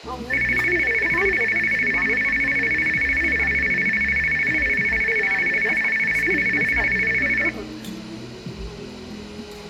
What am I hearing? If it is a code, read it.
A tone that alternates evenly between two pitches, with room echo and the noise of a crowd indoors. There is no code.